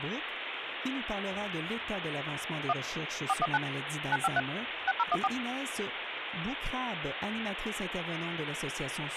DTMF, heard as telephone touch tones, dialled by machine, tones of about 40 ms, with phone line noise. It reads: 1 419 953 6014